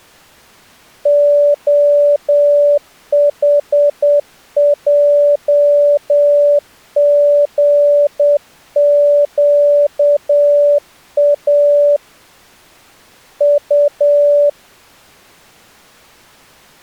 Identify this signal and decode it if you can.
Morse code, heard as a keyed tone, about 8 wpm, 580 Hz. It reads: OHJGQA U